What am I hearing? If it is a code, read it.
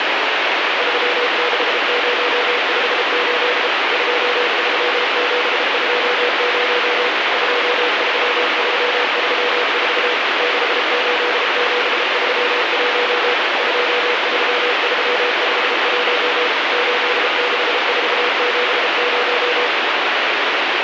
Morse code, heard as a keyed tone, machine-sent, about 33 wpm, 490 Hz, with heavy radio static. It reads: 36058 23720 23334 68731 23351 86470